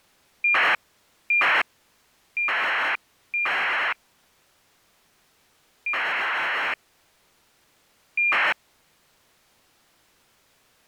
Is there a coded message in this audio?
Yes: ACARS aircraft data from 0.4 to 8.5 s, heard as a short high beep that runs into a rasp, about 2400 baud.